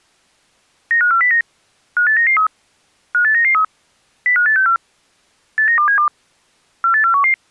Five-tone selective call (CCIR), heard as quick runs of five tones, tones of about 100 ms. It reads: 95409 58993 58993 05864 89272 48411